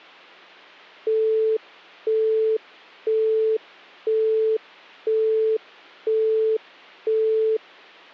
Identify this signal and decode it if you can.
Telephone call progress tone (single-tone plan, as in Europe, Japan and elsewhere), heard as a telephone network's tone, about 440 Hz, 0.5 s on and 0.5 s off. Busy tone.